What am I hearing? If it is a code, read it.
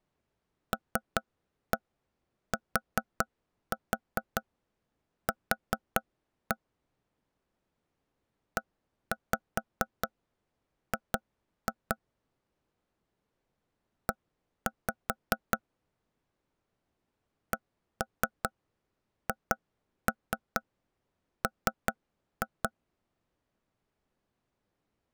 Tap code, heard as taps on a table, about 4 knocks a second. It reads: LTQ EG E CHM